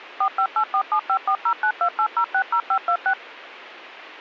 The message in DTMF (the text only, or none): 45847540928060526